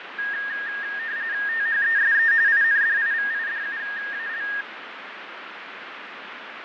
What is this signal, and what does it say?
RTTY (45.45 baud, 170 Hz shift), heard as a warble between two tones, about 1750 Hz centre, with radio static and fading. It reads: THESE INDIVIDUAL